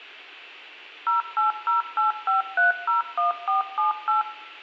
DTMF, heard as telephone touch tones, dialled by machine, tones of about 140 ms, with room echo. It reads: 08085301478